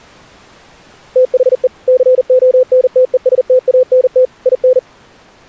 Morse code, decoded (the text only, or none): THE CONTESTANT IN